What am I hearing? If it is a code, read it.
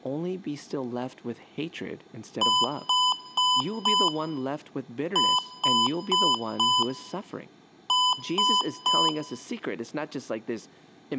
Beep code, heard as beeps from a small speaker, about 1000 Hz, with room echo and speech in English. 4-4-3. In Phoenix BIOS tables: maths coprocessor failure.